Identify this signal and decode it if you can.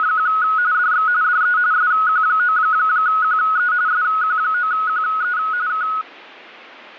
RTTY (45.45 baud, 170 Hz shift), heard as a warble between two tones, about 1370 Hz centre. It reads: … DX DE SQ9QE SQ9QE K